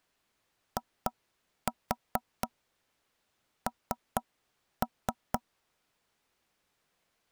Tap code, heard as knocks on wood, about 4 knocks a second. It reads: IN